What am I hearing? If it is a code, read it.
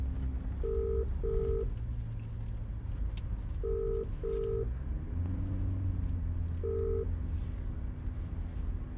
Telephone call progress tone (as in the UK, Ireland, Australia and similar networks), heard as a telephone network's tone, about 400, 450 Hz, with room echo and the noise inside a car. Ringback tone.